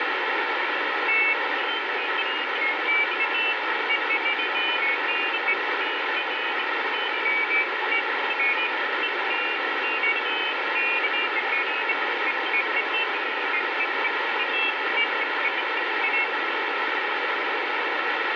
Pairs of high tones at irregular times, with heavy radio static and room echo. There is no code.